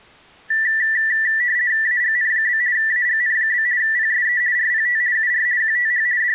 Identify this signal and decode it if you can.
RTTY (50 baud, 170 Hz shift), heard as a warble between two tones, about 1850 Hz centre. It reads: AGN? AGN? PSE RPT UR QTH …